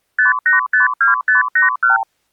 Multi-frequency trunk signalling (R2, with the far end's replies), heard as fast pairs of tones, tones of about 140 ms. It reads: 5852581